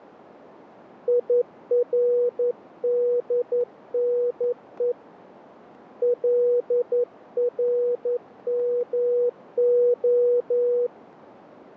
Morse code (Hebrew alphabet), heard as a keyed tone, hand-sent with a paddle, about 11 wpm, 490 Hz, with radio static. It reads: ירדנו לרמה